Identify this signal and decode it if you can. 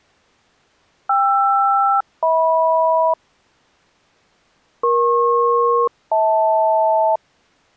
Aircraft SELCAL, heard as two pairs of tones. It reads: KR-HM EP-HL